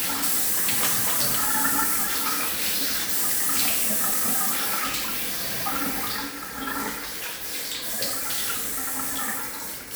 The noise of a restroom. There is no code.